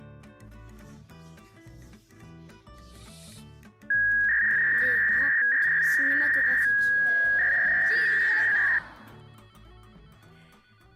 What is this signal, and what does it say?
300-baud modem data (V.21 tones), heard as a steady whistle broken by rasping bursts, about 300 baud, 200 Hz shift.